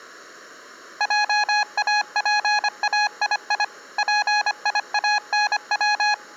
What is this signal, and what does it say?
Morse code (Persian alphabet), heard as a keyed tone, machine-sent, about 25 wpm, 840 Hz. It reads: جاپایی پیانو